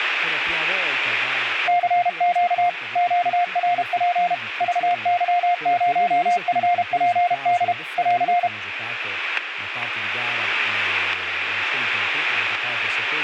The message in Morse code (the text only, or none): CQ QRP VY0FPD <AR>